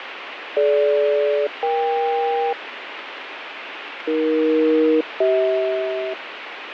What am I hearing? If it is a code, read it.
Aircraft SELCAL, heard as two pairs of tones, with radio static and fading. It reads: DG-EK AE-CH